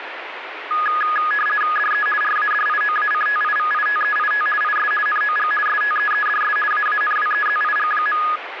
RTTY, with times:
1.8-2.1 DE
2.2-4.5 RADIOACTIVITEIT
4.6-4.9 IS
5.1-5.5 NOG
5.7-6.6 STEEDS
6.7-8.2 AANWEZIG.

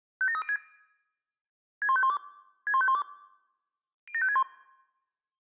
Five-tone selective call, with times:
0.2-0.6 57306
1.8-2.2 61512
2.7-3.0 61512
4.1-4.4 07561

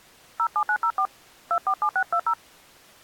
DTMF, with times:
0.4-1.1 07904
1.5-2.3 247620

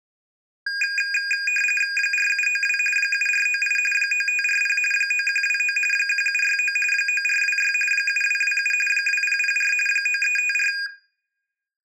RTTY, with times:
2.0-2.8 4792
3.0-3.8 7498
3.9-4.8 9540
4.9-5.8 9129
5.9-6.8 1769
6.9-7.7 9426
7.9-8.7 7227
8.9-9.7 2004
9.9-10.7 9354

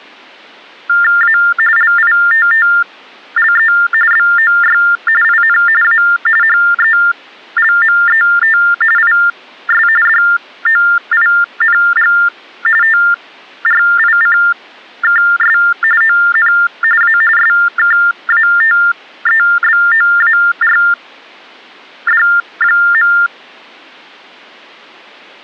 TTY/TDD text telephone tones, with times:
1.2-1.4 A
1.8-3.7 LITTLE
4.1-4.8 BOY
5.2-5.6 IN
5.8-6.0 A
6.4-8.6 HELMET
9.0-9.9 IS
10.1-12.1 DOING
12.8-15.6 TRICKS
16.0-16.5 ON
17.0-17.2 A
17.4-23.1 SKATEBOARD.

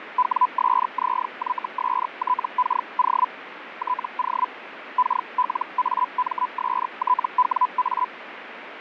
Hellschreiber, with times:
0.2-3.3 WSZYSTKO
3.8-4.5 TO
5.0-8.1 KLAMSTWA

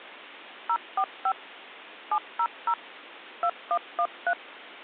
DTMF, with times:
0.7-1.3 045
2.1-2.7 700
3.4-4.3 2113

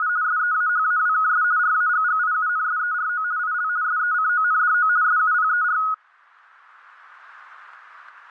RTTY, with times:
0.0-0.1 …
0.2-1.4 SEAHAWKS
1.6-3.2 RAGGIUNSERO
3.4-3.7 IL
3.8-4.9 SECONDO
5.0-5.8 SUPER

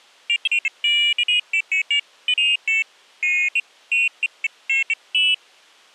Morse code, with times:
none

